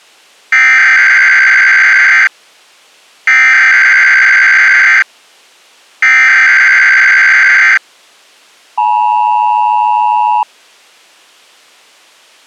Emergency Alert System (SAME) tones (header bursts, then the 853 and 960 Hz attention tone), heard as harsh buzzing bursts, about 520.83 baud.